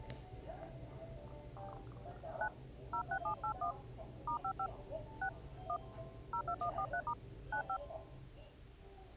DTMF, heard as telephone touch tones, dialled by hand, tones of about 90 ms, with the noise inside a lift. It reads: 9 06781 *55 6 1 02143* 95